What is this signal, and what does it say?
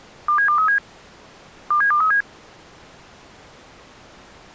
Five-tone selective call (CCIR), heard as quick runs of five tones, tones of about 100 ms. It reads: 27237 27237